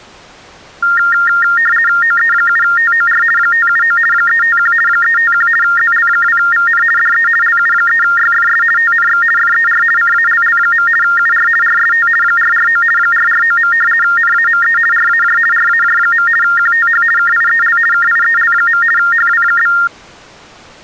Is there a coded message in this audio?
Yes: RTTY (50 baud, 450 Hz shift) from 0.8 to 19.9 s, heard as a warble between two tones, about 1600 Hz centre. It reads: OE7TOR 579 351 351 ZL2VN DE LU3YFS TNX FER CALL. UR RST 449 449. NAME RAJ RAJ. QTH KIEL KIEL. HW?